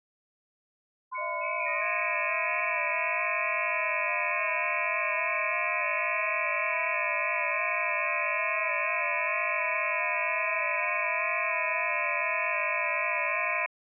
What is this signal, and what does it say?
FT8 (several signals at once), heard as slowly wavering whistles, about 6.25 baud.